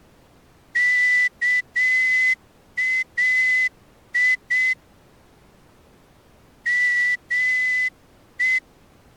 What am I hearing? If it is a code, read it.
Morse code (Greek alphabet), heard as a whistle, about 7 wpm. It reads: ΚΑΙ ΜΕ